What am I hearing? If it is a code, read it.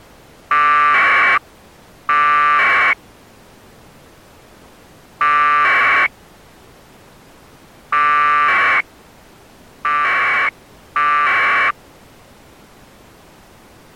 Packet radio (AX.25, as in APRS), 1200 baud, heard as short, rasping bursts.